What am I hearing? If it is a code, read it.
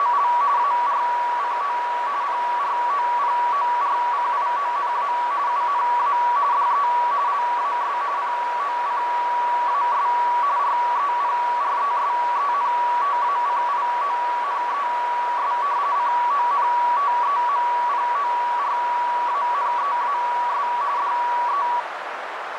RTTY (45.45 baud, 170 Hz shift), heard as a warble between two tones, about 1050 Hz centre, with radio static and a narrow filter. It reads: … ARCO PROPORCIONA UNA DE LAS POCAS REPRESENTACIONES CONTEMPORANEAS DE